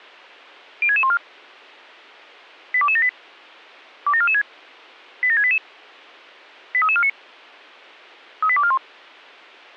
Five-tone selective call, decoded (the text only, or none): 06614 82278 27446 87688 83349 38241